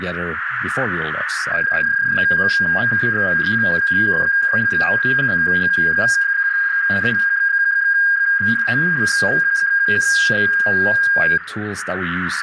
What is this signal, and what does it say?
PSK31 (31.25 baud), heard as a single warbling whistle, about 1600 Hz, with radio static, a narrow filter and speech in English.